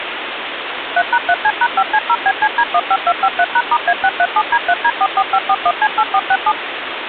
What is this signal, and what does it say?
DTMF, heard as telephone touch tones, dialled by machine, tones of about 60 ms, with phone line noise. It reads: 3#3C#5C0BCD15253#*A637D3D44541C8467